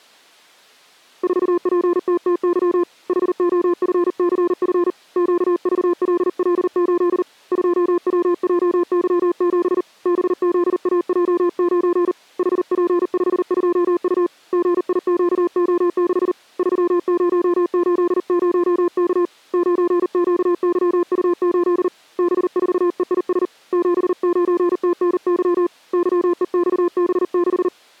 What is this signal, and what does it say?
Morse code, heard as a keyed tone, hand-sent with a paddle, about 39 wpm, 350 Hz. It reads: 4PTTY HOFCF QVLL8 2WJY7 BZAJ9 HP52U GIQO6 3080K 9QYU8 B4EIS 79TNY YEXB6